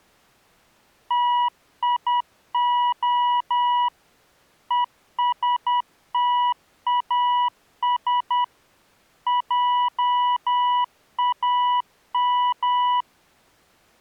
Morse code, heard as a keyed tone, machine-sent, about 10 wpm, 980 Hz. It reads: TIO ESTAS JAM